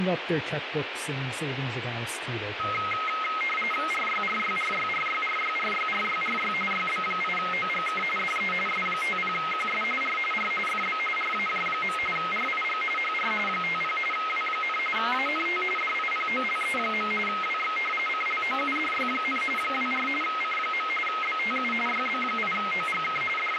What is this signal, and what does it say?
RTTY (45.45 baud, 850 Hz shift), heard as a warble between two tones, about 1700 Hz centre, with radio static and speech in English. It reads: RYRYRYRYRYRYRYRY YB8OGK DE S50QS R R FB RAJ. RIG HR 50 W, ANT DIPOLE. WX CLOUDY, 24 C. BTU YB8OGK …